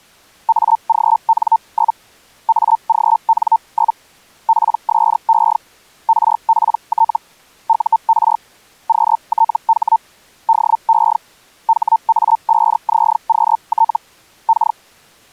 Hellschreiber (Feld-Hell, 122.5 baud), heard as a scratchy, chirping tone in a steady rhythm, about 900 Hz. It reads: AGN? AGN? PSE RPT UR QTH DE HA5ZQT K